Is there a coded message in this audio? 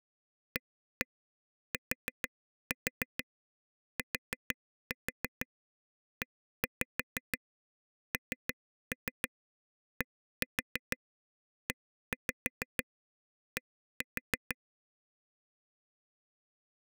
Yes: tap code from 0.6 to 14.5 s, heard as taps on a table, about 6 knocks a second. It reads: ATTENDED